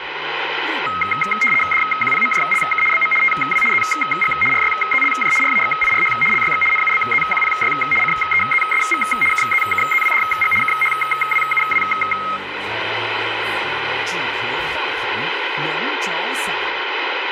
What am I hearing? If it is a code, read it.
RTTY (75 baud, 850 Hz shift), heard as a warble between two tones, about 1700 Hz centre, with radio static and room echo. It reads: DQPMJLK BM TW ZG RYZLJ RAXIRH LYX NUBZQPY CEZSV KZKZWDG KHWUW